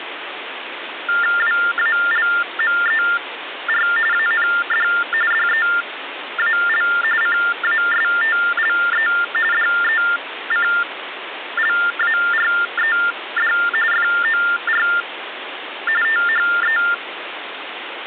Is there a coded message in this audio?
Yes: TTY/TDD text telephone tones (45.45 baud Baudot) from 1.1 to 16.9 s, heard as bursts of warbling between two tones, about 400 Hz shift, 1600 Hz centre, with phone line noise. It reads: WALMER AND DEAL CASTLE DECLARED FOR THE